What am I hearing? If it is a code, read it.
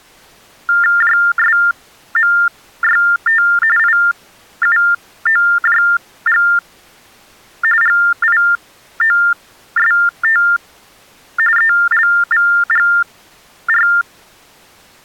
TTY/TDD text telephone tones (45.45 baud Baudot), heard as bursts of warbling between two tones, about 400 Hz shift, 1600 Hz centre. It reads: JSMYT IUOJG GIOST ELVGR